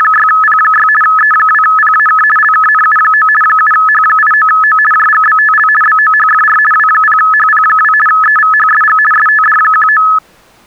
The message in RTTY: … E2PAK LKNU9 7H89O JGBTL BOHFR W0HP2 EVHSG STD19

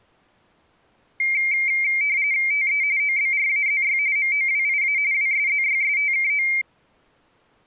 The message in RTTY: TE OBRAZY MOWIA WSZYSTKO

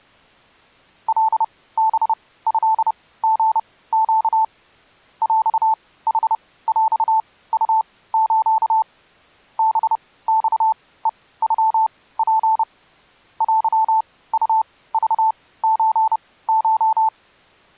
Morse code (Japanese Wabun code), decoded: カハトリネ ヰヌヰウス ハマヘノツ テウクソコ

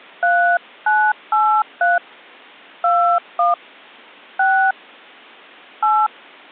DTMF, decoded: 3983 21 6 8

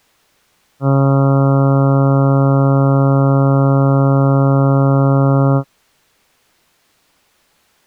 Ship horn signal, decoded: 1 long

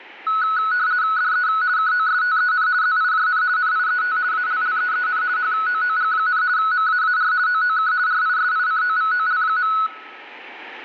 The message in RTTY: DE KOSTEN ZIJN NIET ALLEEN HOOG, MAAR OOK RISICOVOL.

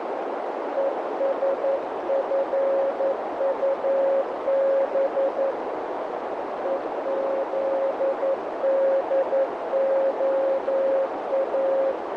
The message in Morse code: ESFUB EZDOA

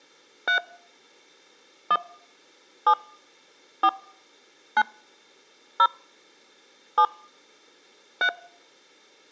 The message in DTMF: 3 1 7 4 9 0 7 3

